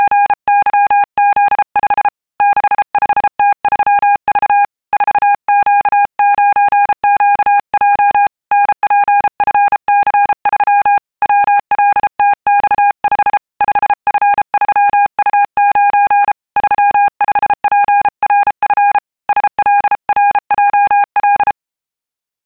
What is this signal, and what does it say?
Morse code, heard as a keyed tone, hand-sent with a bug key, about 33 wpm, 810 Hz. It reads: … 65T3V 4Q9QJ NPFC3 WLTX5 5F3U9 35PRF SLRJL